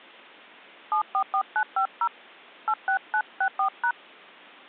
DTMF, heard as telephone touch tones, dialled by hand, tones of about 80 ms. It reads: 744950 86964#